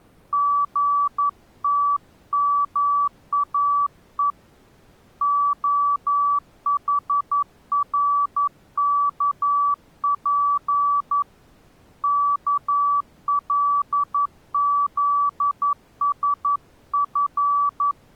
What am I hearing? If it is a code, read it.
Morse code, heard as a keyed tone, hand-sent with a paddle, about 11 wpm, 1150 Hz. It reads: GTMAE OHRKP KLZSF